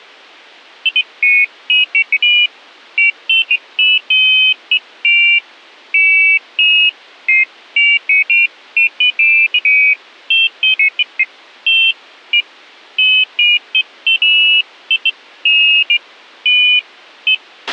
Pairs of high tones at irregular times, with a squelch burst at the end. There is no code.